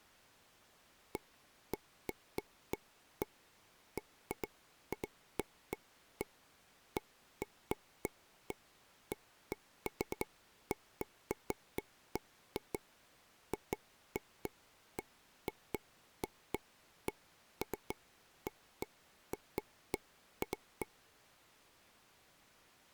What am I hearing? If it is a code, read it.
Irregular taps on a table. There is no code.